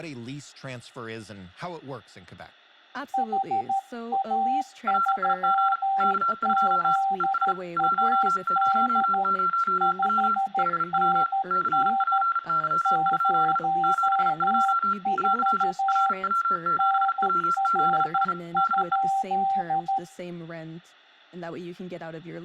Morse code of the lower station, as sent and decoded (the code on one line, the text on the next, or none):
.... .- ...-- --.. .- -.. / ..... -. -. / ----- ....- / -. .-. ..--..
HA3ZAD 5NN 04 NR?